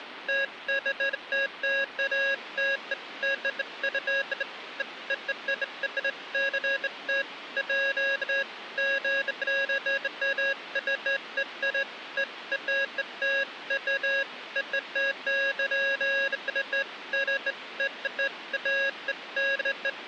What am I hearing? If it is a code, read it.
Beeps of irregular length, with phone line noise. There is no code.